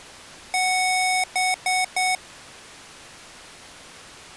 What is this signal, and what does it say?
Beep code, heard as beeps from a small speaker, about 740 Hz. 1 long, 3 short. In Award and IBM BIOS tables: video adapter failure; in AMI BIOS tables: memory failure.